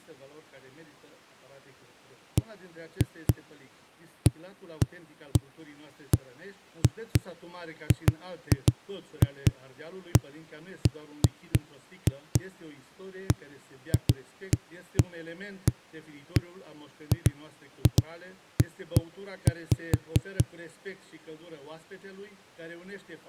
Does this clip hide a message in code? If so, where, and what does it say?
No, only irregular knocks on a wall.